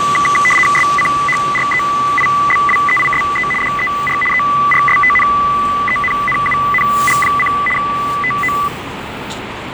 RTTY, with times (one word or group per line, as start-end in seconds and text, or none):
0.8-3.5 SCHREIBWEISE
3.6-4.2 DER
4.3-7.5 ERSTNENNUNG:
7.8-8.5 TO